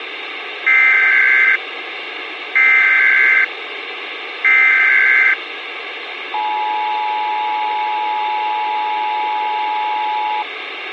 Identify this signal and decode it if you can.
Emergency Alert System (SAME) tones (header bursts, then the 853 and 960 Hz attention tone), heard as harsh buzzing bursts, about 520.83 baud, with radio hiss.